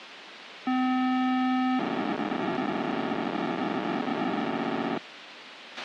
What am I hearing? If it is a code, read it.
POCSAG pager data (512 baud), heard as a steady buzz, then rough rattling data, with radio hiss and a squelch burst at the end.